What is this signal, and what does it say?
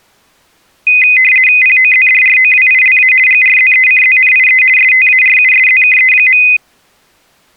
RTTY (50 baud, 450 Hz shift), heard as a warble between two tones, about 2250 Hz centre. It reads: POZDROWILA GRZECZNIE STARUSZKE.